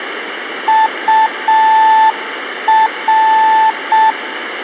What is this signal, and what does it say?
Morse code, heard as a keyed tone, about 6 wpm, 880 Hz, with radio static. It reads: UR